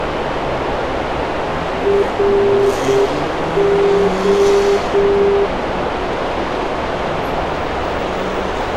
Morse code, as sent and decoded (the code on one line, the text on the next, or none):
.-. ---
RO